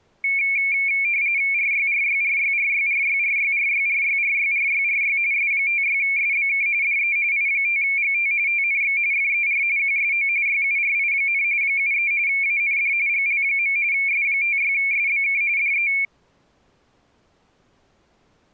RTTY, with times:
1.5-5.2 RYRYRYRYRYRYRYRYRYRYRY
5.3-6.7 S56SBK
6.8-7.2 DE
7.3-8.3 I5GT
8.5-9.0 TNX
9.1-9.6 FER
9.8-10.3 QSO
10.5-11.4 YURI,
11.6-12.1 73
12.3-12.9 AND
13.1-13.8 GL.
13.9-15.4 S56SBK
15.6-15.9 DE

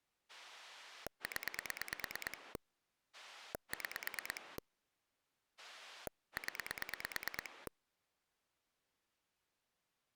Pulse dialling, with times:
0.3-2.6 0
3.1-4.6 6
5.6-7.7 0

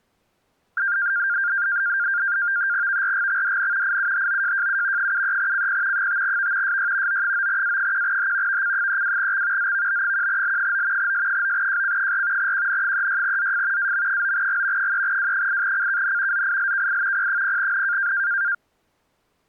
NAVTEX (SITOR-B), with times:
2.9-4.0 VRGXDN
3.8-5.1 IUHOJJU
5.0-6.1 73CP
5.9-6.8 5V
6.6-7.2 SY
7.1-8.6 O9A1H
8.5-9.7 VC32X
9.6-11.1 ZVB1L9
11.0-12.5 S9JC4
12.4-13.9 QN36ZF
13.8-14.9 AM9G
14.8-16.4 3W8CKN
16.3-17.3 ZILKI
17.1-18.1 P0N

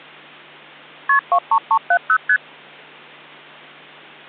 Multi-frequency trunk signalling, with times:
1.1-1.2 KP
1.3-2.2 23370
2.3-2.4 ST

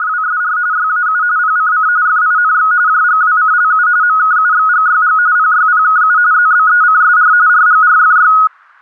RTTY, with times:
0.0-0.6 …
0.7-1.2 YAU
1.4-1.9 PCC
2.1-2.7 FINX
2.9-3.9 JGWCLU
4.0-5.2 MKUXGYG
5.4-6.2 PYPKU
6.3-7.3 ZBECSR
7.5-8.3 RGRFY

